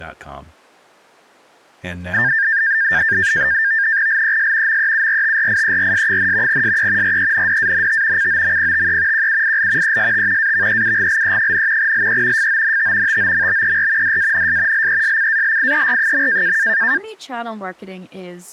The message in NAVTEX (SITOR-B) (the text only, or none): LES MEURTRIERS, SE RENDANT COMPTE QUIL EST AVEUGLE, LE FONT TOMBER DANS LESCALIER.